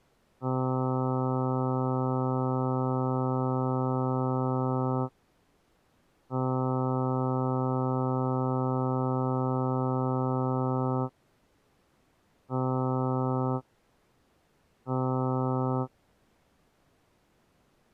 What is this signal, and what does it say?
Ship horn signal, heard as a ship's horn, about 130 Hz. 2 long, 2 short. At sea: I intend to overtake on your port side.